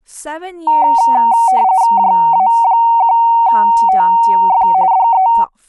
RTTY (45.45 baud, 170 Hz shift), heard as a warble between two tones, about 840 Hz centre, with speech in English. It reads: JA1TF DE